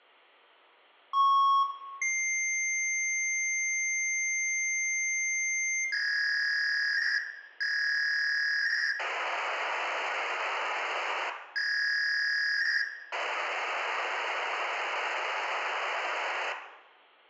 Fax machine handshake, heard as a beep, a long tone, a warble and hiss, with room echo.